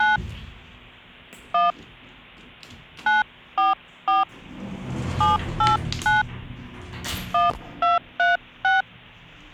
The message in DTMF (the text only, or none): 9 1 944 789 1236